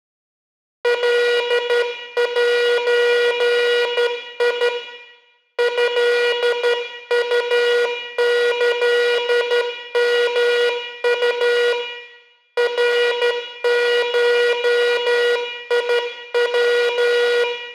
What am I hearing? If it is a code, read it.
Morse code (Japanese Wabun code), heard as a buzzer, hand-sent with a straight key, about 12 wpm, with room echo. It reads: カゼ トウキヨウ ナゴヤ